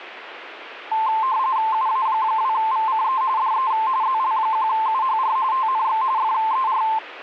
RTTY (45.45 baud, 170 Hz shift), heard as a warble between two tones, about 970 Hz centre, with radio static. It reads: UA2VCE DE ZL1UHR TNX FER